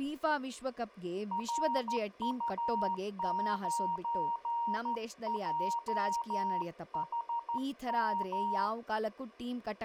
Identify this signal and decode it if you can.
Morse code, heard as a keyed tone, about 13 wpm, 940 Hz, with speech in Kannada. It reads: RU9JHM